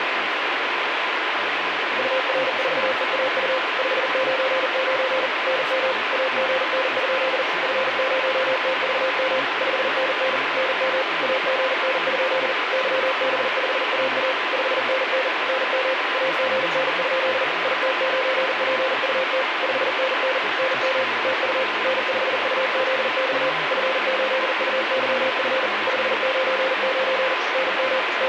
Morse code, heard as a keyed tone, machine-sent, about 40 wpm, 520 Hz, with heavy radio static. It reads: UR4EAU 599 NM AGN? F0TVM 5NN NM AGN? YB5AA 5NN NM AGN? IT9PUT 5NN NM TU N5UZX F8UYF 599 NM …